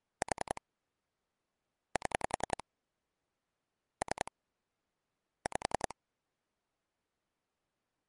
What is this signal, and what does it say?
Pulse dialling, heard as clicks on a phone line, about 10 pulses a second. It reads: 4 7 3 5